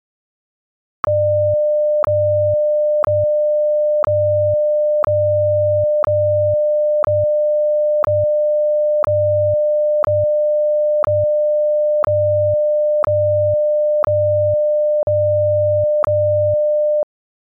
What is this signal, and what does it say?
Radio time signal (WWVH, Hawaii), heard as ticks, one a second.